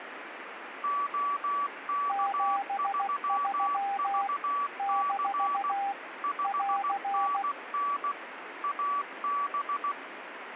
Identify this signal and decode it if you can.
Morse code, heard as two keyed tones, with radio static. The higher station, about 16 wpm, 1150 Hz: OK3VC 5NN AB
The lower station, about 16 wpm, 800 Hz: 73 - <AR>